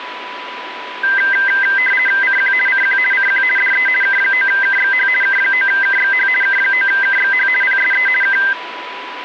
RTTY (50 baud, 450 Hz shift), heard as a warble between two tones, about 1800 Hz centre, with radio static and a steady whistle near 990 Hz. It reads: CQ CQ CQ DE K9KXH K9KXH K9KXH PSE K